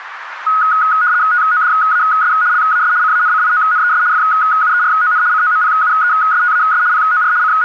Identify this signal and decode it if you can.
RTTY (75 baud, 170 Hz shift), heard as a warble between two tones, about 1360 Hz centre, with radio static. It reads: TODAS LAS CANCIONES FUERON COMPUESTAS POR …